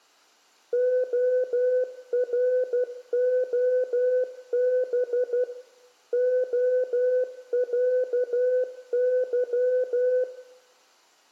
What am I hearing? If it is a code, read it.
Morse code (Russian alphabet), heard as a keyed tone, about 12 wpm, 500 Hz, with room echo. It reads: ОРОБ ОЯЫ